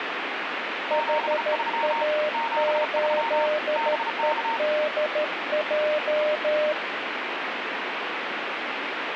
Morse code, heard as two keyed tones, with radio static. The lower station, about 13 wpm, 600 Hz: HA8EDJ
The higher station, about 34 wpm, 920 Hz: 73 73 BK